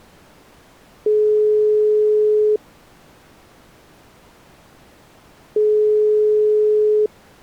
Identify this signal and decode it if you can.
Telephone call progress tone (single-tone plan, as in most of Europe), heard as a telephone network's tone, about 420 Hz, 1.5 s on and 3 s off. Ringback tone.